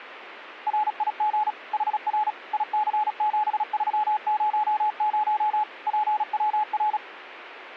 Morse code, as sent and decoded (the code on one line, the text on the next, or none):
.-. .. --. / .... .-. / .. -.-. --... ...-- ----- ----- / .--. .-- .-.
RIG HR IC7300 PWR